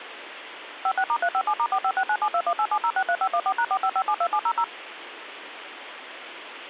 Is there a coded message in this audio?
Yes: DTMF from 0.9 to 4.6 s, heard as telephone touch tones, dialled by machine, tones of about 60 ms, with phone line noise. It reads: 56*357*456972187063514#45572700